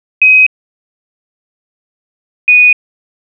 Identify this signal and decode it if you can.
Quindar tones, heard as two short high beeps.